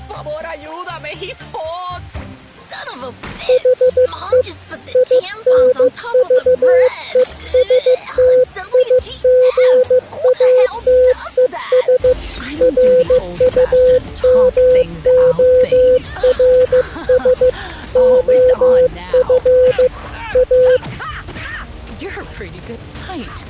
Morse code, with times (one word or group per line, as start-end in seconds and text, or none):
3.5-4.4 HE
5.0-12.1 INVESTIGATES
12.6-17.5 RUMORS
18.0-19.9 OF
20.4-20.8 A